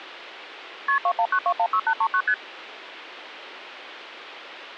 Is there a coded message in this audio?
Yes: multi-frequency trunk signalling (R1, as on North American trunks) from 0.9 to 2.3 s, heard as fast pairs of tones, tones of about 70 ms. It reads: KP 219216839 ST